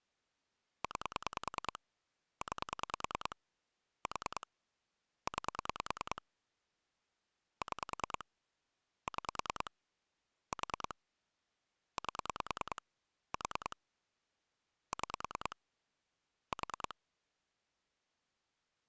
Pulse dialling, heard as clicks on a phone line, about 10 pulses a second. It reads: 9 9 4 9 6 6 4 8 4 6 4